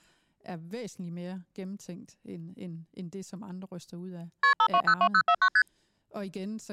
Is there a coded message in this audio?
Yes: multi-frequency trunk signalling (R1, as on North American trunks) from 4.4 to 5.6 s, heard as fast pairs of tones, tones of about 70 ms, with speech in Danish. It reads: KP 5202049 ST